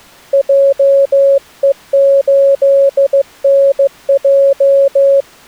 Morse code, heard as a keyed tone, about 15 wpm, 550 Hz. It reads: JE8NJ